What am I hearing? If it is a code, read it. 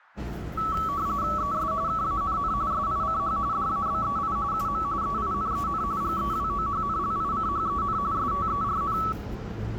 RTTY (45.45 baud, 170 Hz shift), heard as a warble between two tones, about 1220 Hz centre, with the noise inside a subway train. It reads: ES KANN SICH DABEI UM EINEN GEWOHNLICHEN STERN